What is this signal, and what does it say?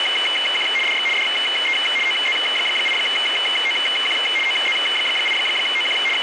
RTTY (75 baud, 850 Hz shift), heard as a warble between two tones, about 2550 Hz centre, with radio static. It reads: … DX DE OZ8OQ OZ8OQ …